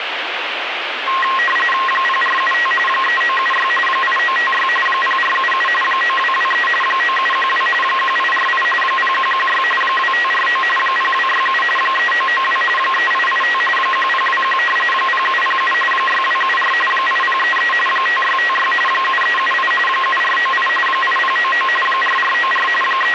RTTY (45.45 baud, 850 Hz shift), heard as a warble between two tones, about 1490 Hz centre, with radio static. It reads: 0475 3976 8956 0477 9223 9712 1848 0116 2549 0267 3992 3885 1021 0707 6274 8033 5656 7378 7498 8099 4494 …